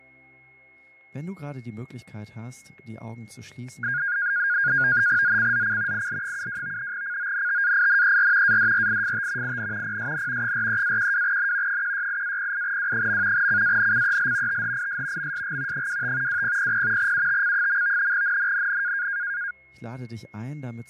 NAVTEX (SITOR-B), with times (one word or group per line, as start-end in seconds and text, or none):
5.2-6.1 ZCZC
5.9-6.9 IL72
6.9-8.6 CONTAINER
8.4-9.6 ADRIFT
9.4-10.0 IN
9.8-10.5 PSN
10.4-11.8 43-12N
11.7-13.5 168-08W.
13.3-14.6 CANCEL
14.5-15.3 THIS
15.2-15.9 MSG
15.7-16.4 25
16.3-17.1 2000
17.0-18.1 UTC.
18.1-19.1 NNNN